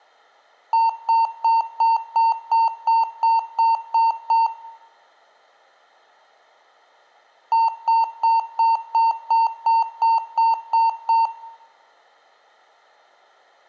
Beep code, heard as beeps from a small speaker, played twice, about 910 Hz, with room echo. 11 short. In AMI BIOS tables: cache memory error.